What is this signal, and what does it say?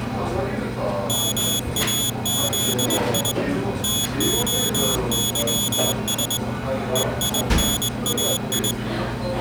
Morse code (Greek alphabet), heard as a high beeper, hand-sent with a straight key, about 21 wpm, 3400 Hz, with the noise of a crowd indoors. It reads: ΜΑΖΙ ΤΟΥΣ ΕΙΝΑΙ